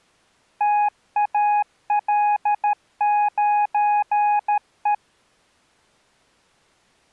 Morse code, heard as a keyed tone, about 13 wpm, 830 Hz. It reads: TAL9E